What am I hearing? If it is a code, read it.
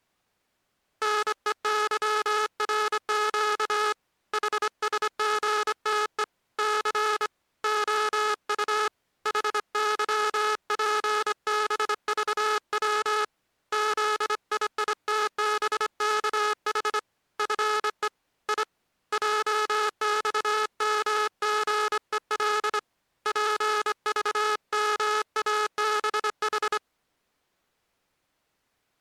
Morse code, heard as a buzzer, hand-sent with a straight key, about 25 wpm. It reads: NEYRQ HSGTE C OU HYPBVW ZIITBKH FE I JXMGEL PVMABH